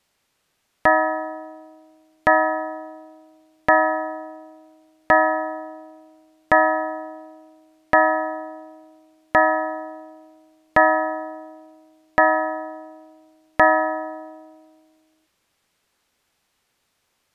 Clock strike, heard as a bell. 10. Ten o'clock.